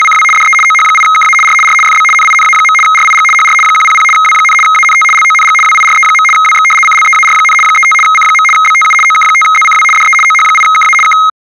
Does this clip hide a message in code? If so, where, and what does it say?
Yes: RTTY (75 baud, 850 Hz shift) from 0.0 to 11.3 s, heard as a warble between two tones, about 1700 Hz centre. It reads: … DE OH8KA R R FB NINA. RIG HR 100 W, ANT LONG WIRE. WX CLEAR, 35 C. BTU OK5ZCW DE OH8KA K